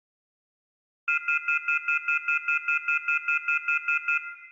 Telephone call progress tone (North American plan), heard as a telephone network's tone, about 1400, 2050, 2450, 2600 Hz, 0.1 s on and 0.1 s off, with room echo. Off-hook warning tone.